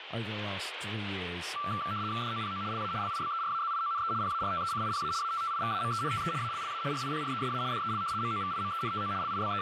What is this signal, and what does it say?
RTTY (75 baud, 170 Hz shift), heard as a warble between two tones, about 1250 Hz centre, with radio static and speech in English. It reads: DOPO LA LIBERAZIONE PARTECIPA ATTIVAMENTE ALLA RIPRESA DEL MOVIMENTO …